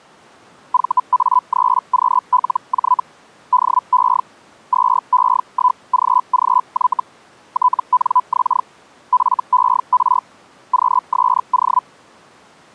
Hellschreiber (Feld-Hell, 122.5 baud), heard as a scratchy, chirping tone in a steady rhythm, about 1000 Hz. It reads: VA3QLJ DE 2E1GGY TNX FER QSO